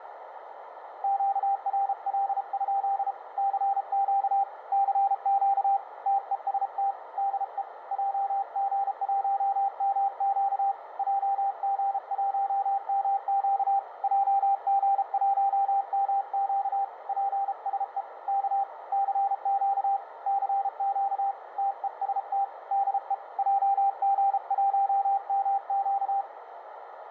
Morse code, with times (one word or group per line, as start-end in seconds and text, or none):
1.0-3.1 QRL?
3.4-4.4 CQ
4.7-5.8 CQ
6.1-6.9 TEST
7.2-7.6 DE
7.9-10.7 JG1MQ
11.0-13.8 JG1MQ
14.0-16.8 JG1MQ
17.1-18.0 PSE
18.3-18.6 K
18.9-20.0 CQ
20.3-21.3 CQ
21.6-22.4 TEST
22.7-23.1 DE
23.4-26.2 JG1MQ